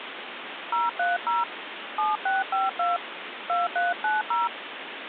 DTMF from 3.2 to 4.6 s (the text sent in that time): 2390